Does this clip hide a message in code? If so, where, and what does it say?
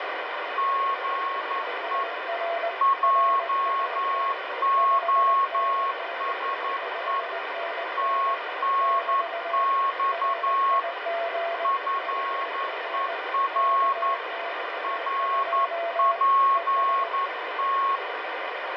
Yes: Morse code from 0.5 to 18.0 s, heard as two keyed tones, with heavy radio static. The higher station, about 11 wpm, 1090 Hz: GE JOSE TNX FER RPT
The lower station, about 19 wpm, 680 Hz: UR RST 5NN 5NN <BT> RIG HR KX2 ES